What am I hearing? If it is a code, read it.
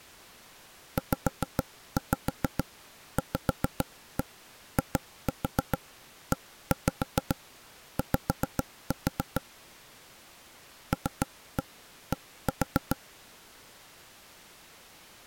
Tap code, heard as knocks on wood, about 7 knocks a second. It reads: ZVIEY LD